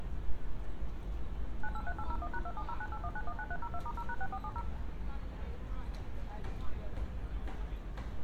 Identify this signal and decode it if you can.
DTMF, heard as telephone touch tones, dialled by machine, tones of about 60 ms, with room echo and street noise. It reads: 983801#270981919302*0#6470